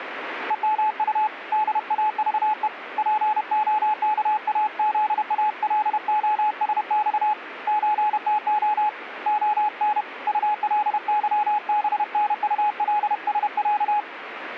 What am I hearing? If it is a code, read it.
Morse code (Russian alphabet), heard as a keyed tone, hand-sent with a paddle, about 31 wpm, 850 Hz, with radio static. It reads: ЕМУ ДАЖЕ ПОКАЗАЛОСЬ ЧТО ОН УЛЫБНУЛСЯ